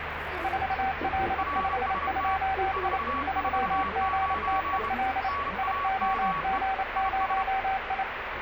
Morse code, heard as two keyed tones, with radio static and the noise inside a bus. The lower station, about 28 wpm, 770 Hz: 4L52I 3GTEL IOG0I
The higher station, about 28 wpm, 1130 Hz: RST 449 NAME IS